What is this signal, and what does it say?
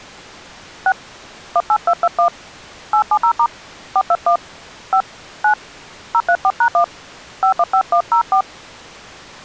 DTMF, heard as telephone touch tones, dialled by hand, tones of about 70 ms. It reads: 6 18221 870* 421 5 9 034#1 515104